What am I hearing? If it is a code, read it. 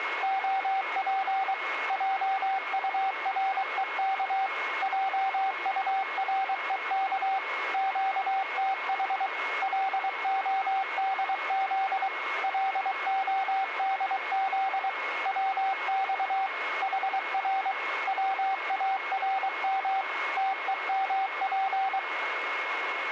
Morse code, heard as a keyed tone, machine-sent, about 23 wpm, 770 Hz, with radio static and a steady whistle near 2170 Hz. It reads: OP JUREK JUREK QTH LODZ LODZ WX HR WARM TEMP